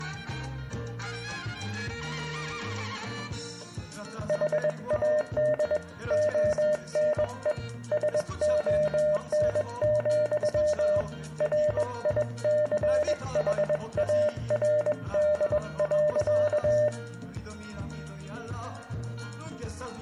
Morse code, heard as a keyed tone, hand-sent with a bug key, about 21 wpm, 600 Hz, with room echo. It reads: HAD ONE SON, RICHARD.